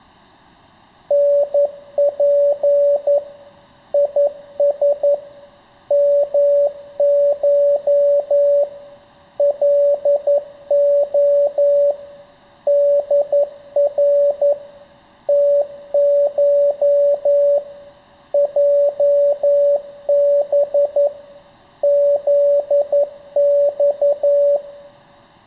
Morse code (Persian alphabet), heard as a keyed tone, machine-sent, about 11 wpm, 570 Hz, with room echo. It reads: نپ یس مش لع در تش جب زخ